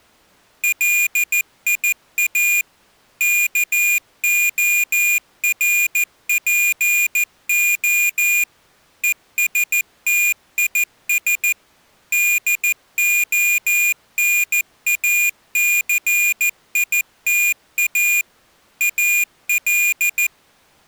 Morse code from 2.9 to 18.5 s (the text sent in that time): KORPO ESTIS DONACITA